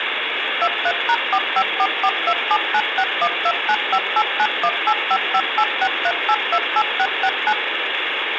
DTMF, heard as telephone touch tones, dialled by machine, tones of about 60 ms, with phone line noise. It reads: 23#454427961295891855863828669